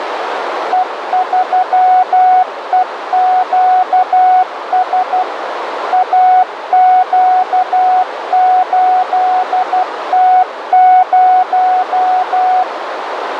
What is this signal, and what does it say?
Morse code, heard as a keyed tone, machine-sent, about 12 wpm, 740 Hz, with radio static and a narrow filter. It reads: E3EQS AQ8T0